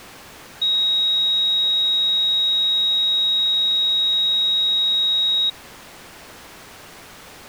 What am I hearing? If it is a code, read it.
A steady tone. There is no code.